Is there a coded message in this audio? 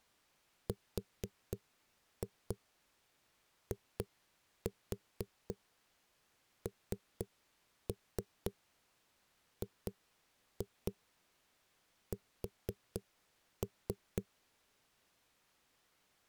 Yes: tap code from 0.7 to 14.3 s, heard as knocks on a wall, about 4 knocks a second. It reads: RINGS